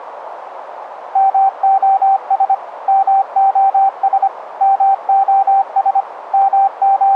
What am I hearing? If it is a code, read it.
Morse code, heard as a keyed tone, machine-sent, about 25 wpm, 780 Hz, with radio static and a narrow filter. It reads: MOS MOS MOS …